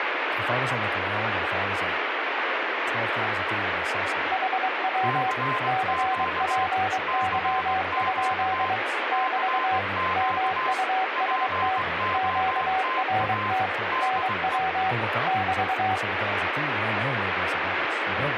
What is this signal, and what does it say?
Morse code, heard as two keyed tones, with radio static and speech in English. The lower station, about 23 wpm, 760 Hz: HW CPY? <BT> MUST QRT NW <BT>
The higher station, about 20 wpm, 1040 Hz: CQ CQ CQ POTA DE